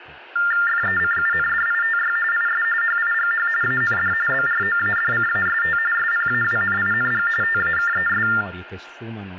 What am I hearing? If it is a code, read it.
TTY/TDD text telephone tones (45.45 baud Baudot), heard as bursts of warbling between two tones, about 400 Hz shift, 1600 Hz centre, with hum, room echo and speech in Italian. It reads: FECUNDITY IS HIGH AND BROADCAST SPAWNING TAKES